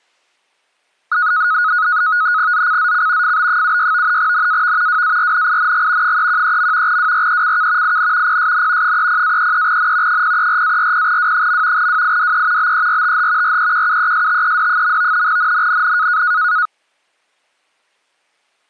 NAVTEX (SITOR-B), 100 baud, 170 Hz shift, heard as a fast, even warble, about 1360 Hz centre. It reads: ZCZC FB76 NAV WARNING 313. WRECK IN PSN 30-33N 034-40W. WIDE BERTH REQUESTED. NNNN